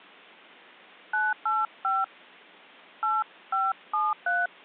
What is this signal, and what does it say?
DTMF, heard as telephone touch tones, dialled by hand, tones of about 200 ms. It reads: 985 8573